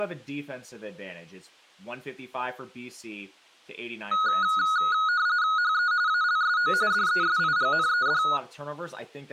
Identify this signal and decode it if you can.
RTTY (45.45 baud, 170 Hz shift), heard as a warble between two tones, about 1360 Hz centre, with speech in English. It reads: HE ALSO DESIGNED